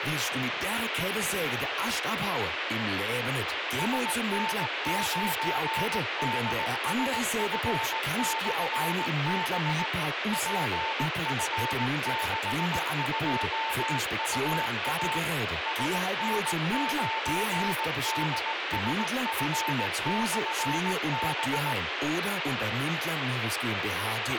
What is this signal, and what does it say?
Morse code, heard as a keyed tone, machine-sent, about 18 wpm, 890 Hz, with radio hiss and a squelch burst at the end. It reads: SN9DSF/B PF62UA SN9DSF/B